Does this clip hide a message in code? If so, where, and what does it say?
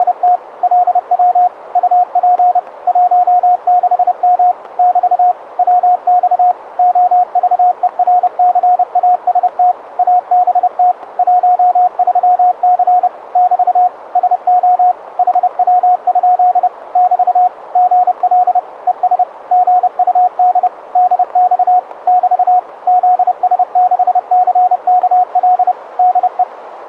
Yes: Morse code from 0.0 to 26.5 s, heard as a keyed tone, machine-sent, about 30 wpm, 720 Hz, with radio static. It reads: … LW UP 16M <BT> WX OVERCAST ABT 13C <BT> SO HW? <BT> GL ES GUD DX <BT> ZS6CKL DE